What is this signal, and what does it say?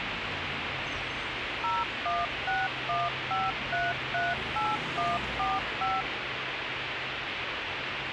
DTMF, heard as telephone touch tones, dialled by machine, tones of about 200 ms, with radio hiss and street noise. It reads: 01615338145